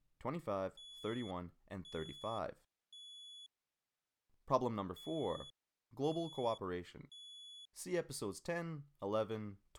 Alarm pattern, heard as an alarm's beeps, played twice, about 3400 Hz, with speech in English. Temporal three. Smoke or fire, evacuate.